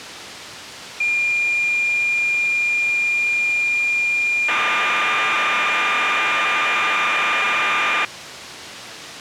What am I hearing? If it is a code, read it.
Cassette data (Kansas City type), 1200 baud, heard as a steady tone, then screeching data.